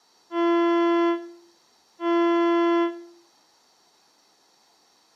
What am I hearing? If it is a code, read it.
Ship horn signal, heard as a ship's horn, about 340 Hz, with room echo. 2 short. At sea: I am altering course to port.